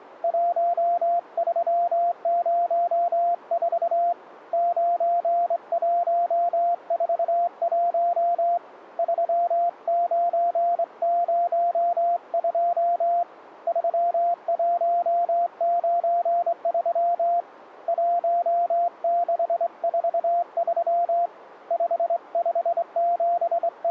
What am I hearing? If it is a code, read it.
Morse code, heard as a keyed tone, hand-sent with a straight key, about 24 wpm, 690 Hz. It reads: 1304 9141 3902 3193 1643 …